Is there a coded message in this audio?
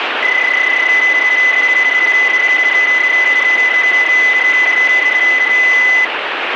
Yes: PSK31 (31.25 baud) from 0.2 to 6.0 s, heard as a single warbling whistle, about 2000 Hz, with radio static.